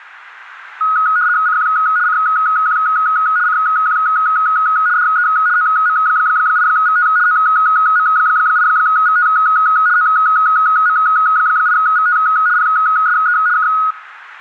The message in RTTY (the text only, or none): CQ CQ CQ DE OM8VT OM8VT OM8VT PSE K